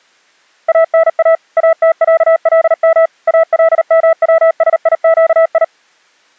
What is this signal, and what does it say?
Morse code (Arabic alphabet), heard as a keyed tone, machine-sent, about 38 wpm, 650 Hz. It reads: انا اتعلم الموسيقي